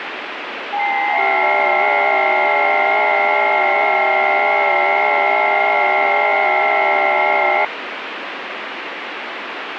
FT8 (several signals at once), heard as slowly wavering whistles, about 6.25 baud, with radio static.